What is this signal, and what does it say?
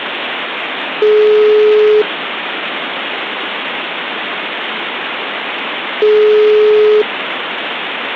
Telephone call progress tone (single-tone plan, as in most of Europe), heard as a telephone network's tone, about 420 Hz, 1 s on and 4 s off, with phone line noise. Ringback tone.